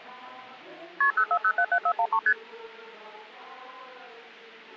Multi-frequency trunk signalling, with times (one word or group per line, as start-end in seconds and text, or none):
1.0-1.1 KP
1.2-2.2 04077413
2.3-2.3 ST